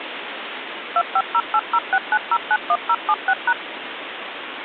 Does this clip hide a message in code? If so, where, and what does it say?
Yes: DTMF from 1.0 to 3.5 s, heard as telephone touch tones, dialled by machine, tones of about 60 ms, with phone line noise. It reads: 2508069091076#